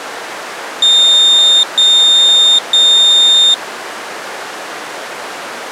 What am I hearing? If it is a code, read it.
Beep code, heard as a piezo beeper, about 3650 Hz. 3 long. In IBM BIOS tables: keyboard card error.